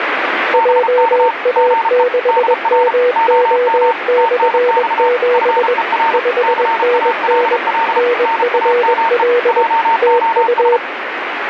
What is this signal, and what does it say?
Morse code, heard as two keyed tones, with radio static. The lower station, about 21 wpm, 490 Hz: JA6MO/7 5NN NFL TU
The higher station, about 33 wpm, 910 Hz: BK GE DR OM TNX FER CALL NAME JOS